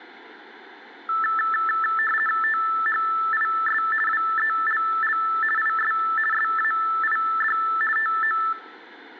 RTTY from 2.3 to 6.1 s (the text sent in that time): THIS WELL IS